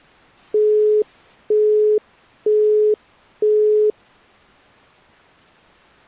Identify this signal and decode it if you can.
Telephone call progress tone (single-tone plan, as in Europe, Japan and elsewhere), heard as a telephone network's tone, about 420 Hz, 0.48 s on and 0.48 s off. Busy tone.